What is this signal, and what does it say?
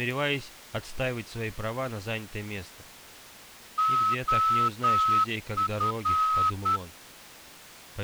Morse code, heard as a whistle, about 10 wpm. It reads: OF